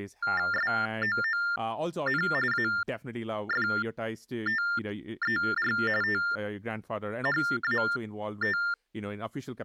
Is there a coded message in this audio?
Yes: TTY/TDD text telephone tones (45.45 baud Baudot) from 0.2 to 8.7 s, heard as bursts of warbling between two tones, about 400 Hz shift, 1600 Hz centre, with speech in English. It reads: SOON AFTER THAT